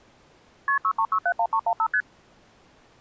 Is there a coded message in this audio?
Yes: multi-frequency trunk signalling (R1, as on North American trunks) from 0.7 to 2.0 s, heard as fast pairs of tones, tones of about 70 ms. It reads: KP 63671315 ST